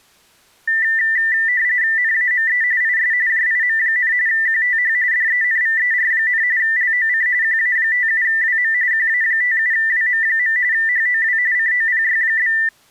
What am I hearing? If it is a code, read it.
RTTY (45.45 baud, 170 Hz shift), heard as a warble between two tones, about 1900 Hz centre. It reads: NAME IS JIM, QTH DENVER, LOC QA57WM QA57WM. HOW COPY?